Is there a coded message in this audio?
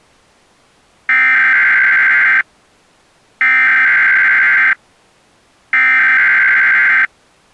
Yes: Emergency Alert System (SAME) tones (header bursts) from 1.1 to 7.1 s, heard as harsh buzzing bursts, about 520.83 baud.